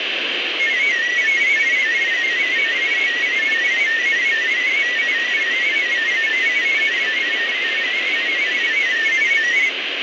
Multi-tone FSK (Olivia or MFSK type), about 500 Hz wide, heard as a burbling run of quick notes, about 31.25 baud, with radio static.